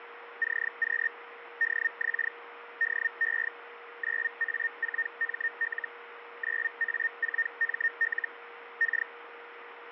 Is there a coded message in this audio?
Yes: Hellschreiber (Feld-Hell, 122.5 baud) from 0.4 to 9.1 s, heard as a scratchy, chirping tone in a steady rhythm, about 1850 Hz, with radio static and a steady whistle near 470 Hz. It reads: CQ DX DE 9A4ML 9A4ML K